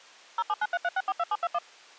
DTMF, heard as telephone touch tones, dialled by machine, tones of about 40 ms. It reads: 07933642721